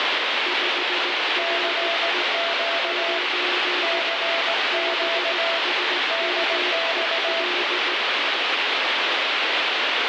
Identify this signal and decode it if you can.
Morse code, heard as two keyed tones, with heavy radio static. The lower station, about 17 wpm, 360 Hz: 5RE 9 BSMEL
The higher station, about 18 wpm, 670 Hz: CQ CQ DX